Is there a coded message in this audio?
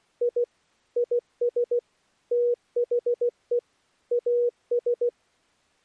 Yes: Morse code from 0.2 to 5.1 s, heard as a keyed tone, machine-sent, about 16 wpm, 480 Hz. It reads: I IS THE AS